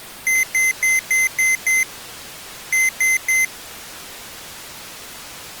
Beep code, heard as beeps from a small speaker, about 2050 Hz. 6-3.